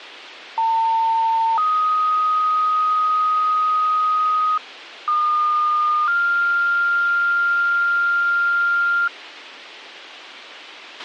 Two-tone page, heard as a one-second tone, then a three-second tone, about 900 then 1250 Hz, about 1220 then 1400 Hz, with a squelch burst at the end.